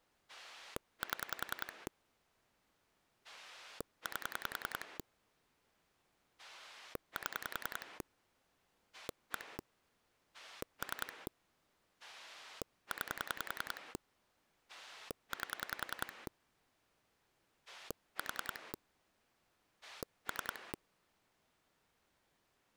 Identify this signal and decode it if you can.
Pulse dialling, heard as a rotary dial, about 10 pulses a second. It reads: 7 8 7 1 3 9 8 4 3